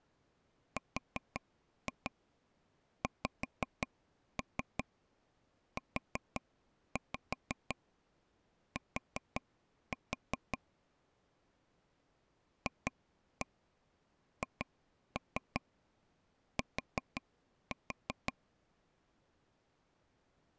Tap code, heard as taps on a table, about 5 knocks a second. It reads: RXUT FHT